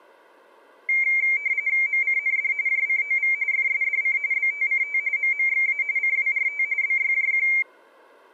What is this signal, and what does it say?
RTTY (45.45 baud, 170 Hz shift), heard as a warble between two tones, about 2200 Hz centre. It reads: MCND JCOV FSDC BTCT MMXA CWRT BYJQ